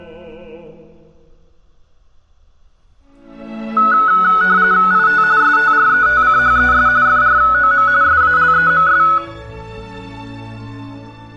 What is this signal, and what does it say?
RTTY (45.45 baud, 170 Hz shift), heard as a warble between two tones, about 1380 Hz centre, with room echo. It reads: IT STRETCHES FROM SALEMS